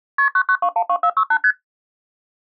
Multi-frequency trunk signalling (R1, as on North American trunks), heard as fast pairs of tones, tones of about 70 ms. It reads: KP 99212468 ST